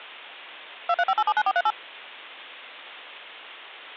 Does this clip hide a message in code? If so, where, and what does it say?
Yes: DTMF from 0.9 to 1.7 s, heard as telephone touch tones, dialled by machine, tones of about 50 ms. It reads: 235879438